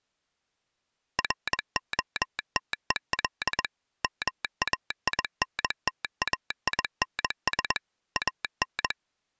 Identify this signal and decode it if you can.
Morse code, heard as a telegraph sounder, machine-sent, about 21 wpm. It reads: ROTEL MAINTAINS AN